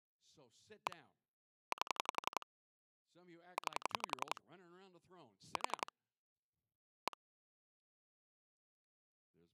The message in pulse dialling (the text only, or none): 1 8 9 4 1